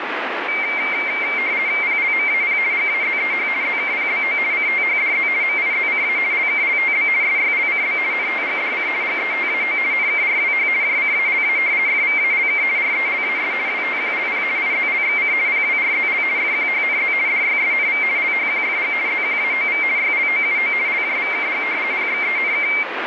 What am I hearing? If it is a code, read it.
RTTY (50 baud, 170 Hz shift), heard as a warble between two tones, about 2200 Hz centre, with radio static. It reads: PLMAP GAZEH ZKPBO CTHDZ MIZCA LKLTB SYLCB NTGDC GETAO NKRWH JCALA FVALK RELAS WTQLP IZLXC PWRZL FQHNZ DYSNV LHQFG ZQAOV YLOUO LJVKG PXENK